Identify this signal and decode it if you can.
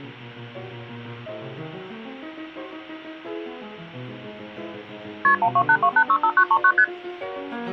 Multi-frequency trunk signalling (R1, as on North American trunks), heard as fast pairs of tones, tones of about 70 ms. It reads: KP 1282865939 ST